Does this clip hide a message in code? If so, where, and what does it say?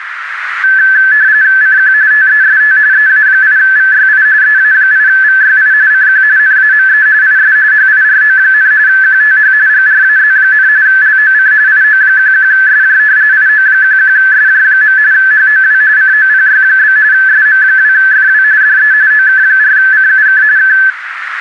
Yes: RTTY (45.45 baud, 170 Hz shift) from 0.6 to 20.9 s, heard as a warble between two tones, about 1650 Hz centre, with radio static and a narrow filter. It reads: CQ TEST EA8VYI EA8VYI CQ NAME IS HIRO, QTH GRAZ, LOC IO11SJ IO11SJ. HOW COPY? SM2FW DE OK4CUK K